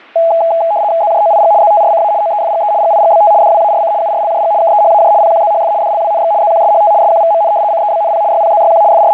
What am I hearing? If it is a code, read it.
RTTY (75 baud, 170 Hz shift), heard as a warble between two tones, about 750 Hz centre. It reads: ZJOIG ZTRCA OEFGE GIGBT DWARC URLJG KEHAJ PQZHF DLWNX ZQSHT SQVMN CEBNP YPZYQ …